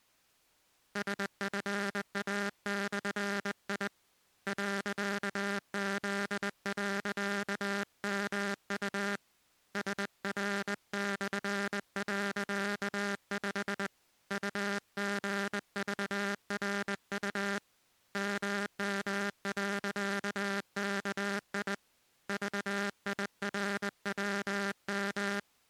Morse code, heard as a buzzer, hand-sent with a straight key, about 20 wpm. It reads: SFA/I .Z.MU SR/.5 UGVRU MM.KI VIRWM